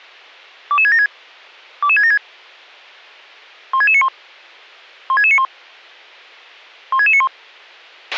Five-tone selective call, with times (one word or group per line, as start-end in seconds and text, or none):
0.7-1.1 22676
1.8-2.2 22676
3.7-4.1 16691
5.1-5.4 16691
6.9-7.3 16691